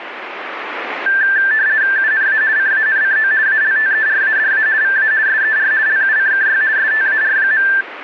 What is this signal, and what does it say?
RTTY (50 baud, 170 Hz shift), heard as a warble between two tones, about 1650 Hz centre, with radio static. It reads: UNA CANCO ALTERADA VA SER LUCKY STAR.